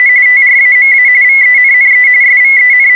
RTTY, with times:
0.0-0.1 …
0.3-1.1 TRAMA
1.2-2.1 VENNE
2.2-3.0 …

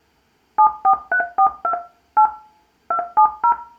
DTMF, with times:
0.6-1.7 74342
2.2-2.3 8
2.9-3.5 270

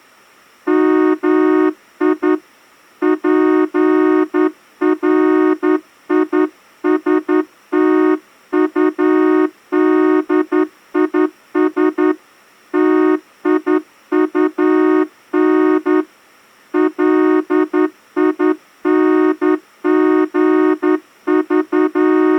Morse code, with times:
0.7-2.3 MI
3.0-12.1 PRISTUDIS
12.7-16.0 TIUN
16.7-22.4 …

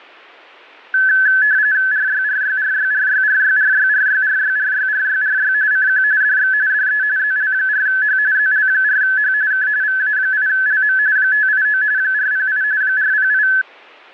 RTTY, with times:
1.9-5.5 RYRYRYRYRYRYRYRYRYRYRY
5.7-6.0 CQ
6.2-6.5 DX
6.7-7.0 DE
7.2-8.2 ZL4H
8.3-9.3 ZL4H
9.5-9.7 K
9.8-11.0 VA8LM
11.2-11.8 589
12.0-12.6 408
12.8-13.5 408

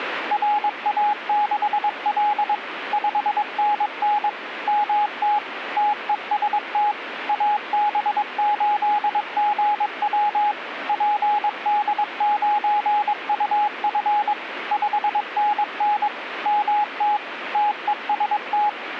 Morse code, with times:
0.3-2.5 RA6L
2.9-4.3 5NN
4.7-5.4 MT
5.8-6.9 TEST
7.3-10.5 AB8GW
10.9-14.3 PD9UF
14.7-16.1 5NN
16.5-17.2 MT
17.5-18.7 TEST

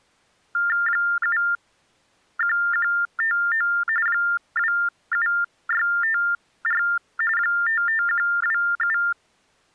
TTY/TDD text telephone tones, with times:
0.9-3.7 71159
4.1-6.8 27654
7.4-9.0 55127

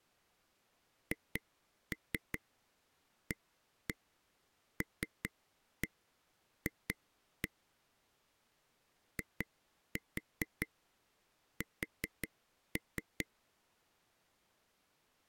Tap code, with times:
1.1-7.5 HALF
9.2-13.3 IS

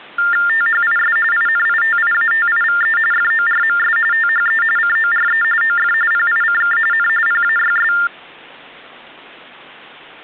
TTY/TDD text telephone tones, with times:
0.5-1.2 THIS
1.3-3.0 INITIATIVE
3.1-4.0 FORMS
4.1-4.6 THE
4.8-5.4 CORE
5.6-5.9 OF
6.1-6.8 PICK
6.9-7.1 N
7.3-7.9 PAYS

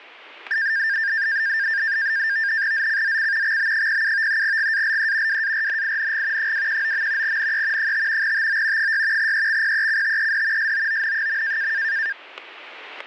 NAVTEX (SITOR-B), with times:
2.7-3.6 ZCZC
3.4-4.4 XB07
4.4-5.4 GALE
5.3-6.5 WARNING
6.4-7.4 219.
7.2-7.9 NE
7.8-8.3 5
8.2-8.9 TO
8.8-9.3 6
9.2-10.7 EXPECTED
10.6-11.7 SOON.

